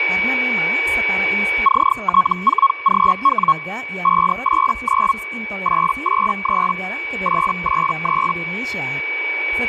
Hellschreiber (Feld-Hell, 122.5 baud), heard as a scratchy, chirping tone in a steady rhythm, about 1100 Hz, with radio static, a steady whistle near 2280 Hz and speech in Indonesian. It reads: CT4GW 589 883 883